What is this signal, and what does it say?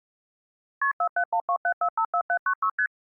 Multi-frequency trunk signalling (R1, as on North American trunks), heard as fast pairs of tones, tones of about 80 ms. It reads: KP 47127454796 ST